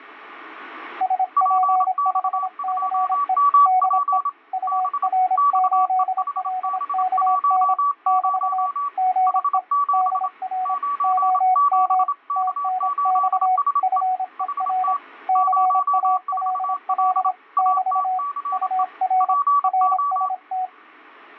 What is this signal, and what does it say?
Morse code, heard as two keyed tones. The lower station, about 26 wpm, 740 Hz: SP5CE DE UR8LKN <BT> GE DR OM TNX FER CALL <BT> UR RST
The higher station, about 27 wpm, 1140 Hz: PX2MP B XEHB10 H7 97K8SE HT 04L ATCE PO